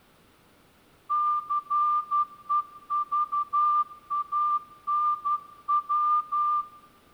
Morse code, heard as a whistle, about 11 wpm, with room echo. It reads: CEVANW